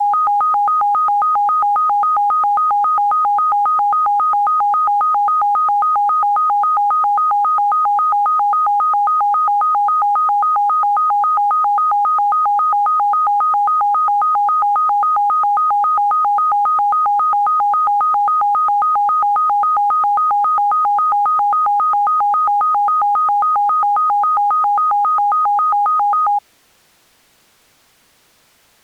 A tone that alternates evenly between two pitches. There is no code.